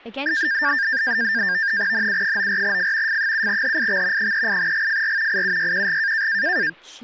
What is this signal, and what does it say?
NAVTEX (SITOR-B), 100 baud, 170 Hz shift, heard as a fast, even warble, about 1700 Hz centre, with speech in English. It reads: NU94F F7HIX 38GFR IUYQG